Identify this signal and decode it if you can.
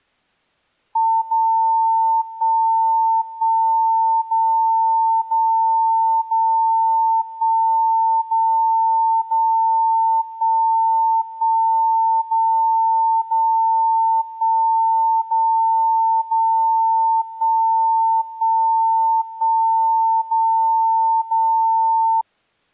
Radio time signal (DCF77), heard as a tone whose level steps once a second, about 900 Hz. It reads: 0 1 1 0 0 0 1 0 0 1 1 0 0 1 0 0 1 1 1 0 0